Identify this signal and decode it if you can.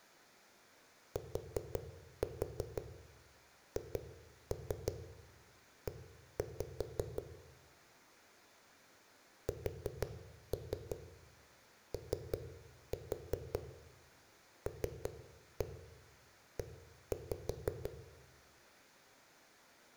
Tap code, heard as knocks on a wall, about 5 knocks a second, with room echo. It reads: THE SOLE